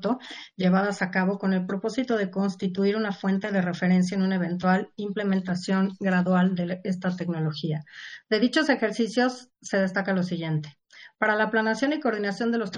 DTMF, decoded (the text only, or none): none